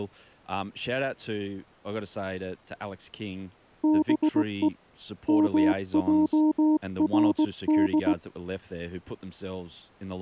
Morse code (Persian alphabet), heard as a keyed tone, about 18 wpm, 310 Hz, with speech in English. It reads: به مجرد